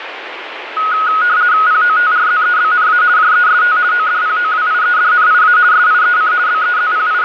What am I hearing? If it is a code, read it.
RTTY (50 baud, 170 Hz shift), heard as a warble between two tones, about 1360 Hz centre, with radio static. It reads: POTRZEBNA JEST ODPOWIEDNIA SIEC …